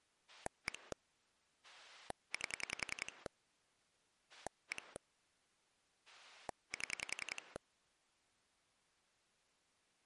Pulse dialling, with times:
0.3-0.9 1
1.6-3.3 8
4.3-5.0 1
6.1-7.6 7

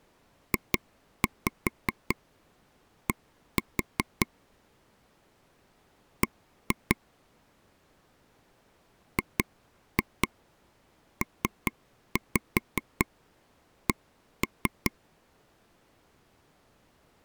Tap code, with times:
0.5-4.3 JD
6.2-7.0 B
9.2-14.9 GPC

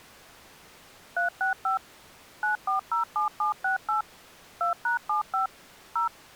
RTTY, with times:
none

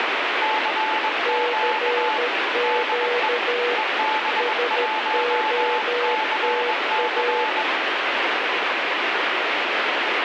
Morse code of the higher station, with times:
0.4-2.2 CQ
2.6-3.3 DE
3.8-7.6 EB1CC

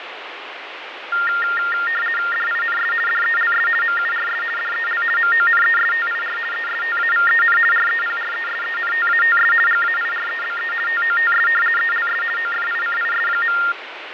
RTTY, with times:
2.3-2.9 DINS
3.1-3.7 DELS
3.8-4.4 MURS
4.6-5.0 DEL
5.2-6.4 MONESTIR
6.5-7.6 ESTAVEN
7.7-9.5 REPRESENTATS
9.7-10.7 GAIREBE
10.9-11.5 TOTS
11.8-12.2 ELS
12.4-13.6 OFICIS.

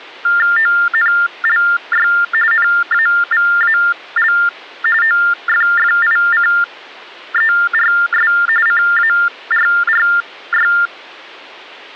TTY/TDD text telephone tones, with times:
0.6-2.1 ONLY
2.5-4.3 NAVAL
5.0-8.3 OFFICERS
8.7-10.7 CARRY

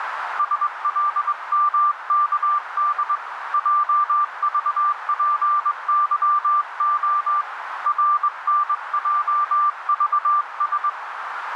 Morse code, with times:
0.4-3.2 SLMKD
3.5-7.4 JVPYO
7.9-10.9 RNJVS

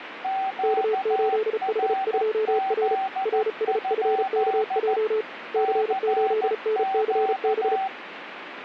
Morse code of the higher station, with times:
0.2-5.0 QRZ?
5.6-7.9 CQ

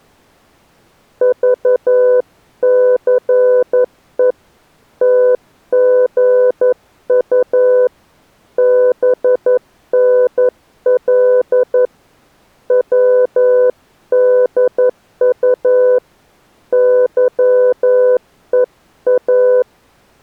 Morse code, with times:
1.2-4.3 VCE
5.0-7.9 TGU
8.6-11.9 BNL
12.7-16.0 WDU
16.7-19.6 YEA

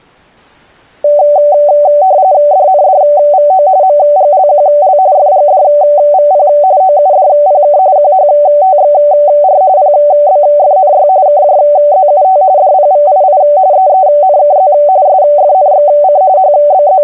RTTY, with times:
2.5-3.7 DNDVO
3.8-5.0 MGLQL
5.2-6.5 FGDVP
6.8-7.8 OUDPK
8.0-9.6 QHTXR
9.8-11.1 PBFNY
11.3-12.4 KJZUT
12.6-13.4 DPVII
13.7-14.7 EENKZ
15.1-16.2 SFNXC
16.4-17.0 …

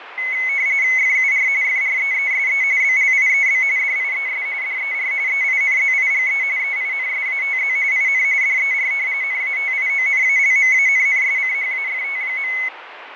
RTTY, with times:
1.0-1.5 FUR
1.6-2.6 FREESE
2.8-3.6 BLIEB
3.8-4.5 DIES
4.6-5.1 DER
5.3-6.4 EINZIGE
6.6-7.8 EINSATZ
7.9-8.2 IN
8.4-8.9 DER
9.2-12.5 NATIONALMANNSCHAFT.

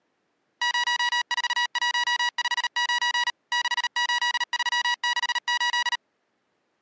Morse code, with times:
0.6-3.3 04159
3.5-6.0 68368

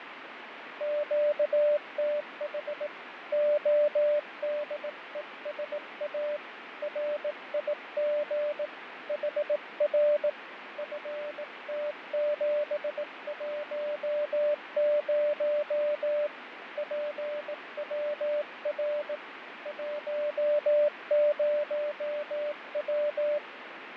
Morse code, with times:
0.8-2.9 QTH
3.3-6.4 ODESA
6.8-8.7 RIG
9.1-10.3 HR
10.8-16.3 FT710
16.8-19.2 PWR
19.7-23.4 10W

